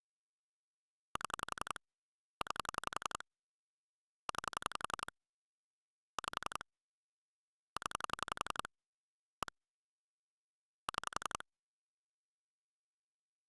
Pulse dialling, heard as clicks on a phone line, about 11 pulses a second. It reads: 7 9 9 5 0 1 6